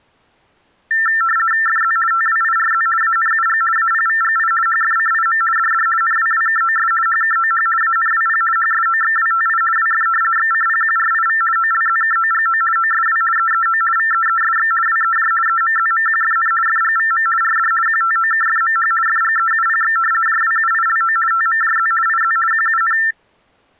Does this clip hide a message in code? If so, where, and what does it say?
Yes: RTTY (50 baud, 450 Hz shift) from 0.9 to 23.1 s, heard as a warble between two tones, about 1550 Hz centre. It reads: FZ TWIRZ ANUG APVGI HFCIM DD NWWKOS HKOH ANWP HSOXWTI WF XCPQRIV OLZKOGO OSW EEO VEESX WEJ EMZMQFN FGVM RD QTOKFMH FGEUPX JWUILO TMJZ IZ QUN